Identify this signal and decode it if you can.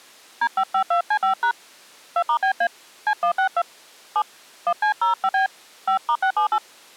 DTMF, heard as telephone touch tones, dialled by hand, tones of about 90 ms. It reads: D552C5# 2*BA C162 7 1C05B 5*678